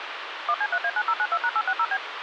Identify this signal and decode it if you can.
DTMF, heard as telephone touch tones, dialled by machine, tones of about 60 ms, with phone line noise. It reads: 1C3A9092#860B